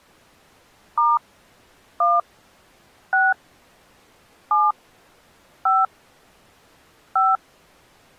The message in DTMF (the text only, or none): * 1 6 7 5 5